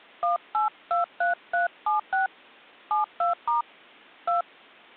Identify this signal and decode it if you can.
DTMF, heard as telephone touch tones, dialled by hand, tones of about 140 ms. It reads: 1823376 72* 2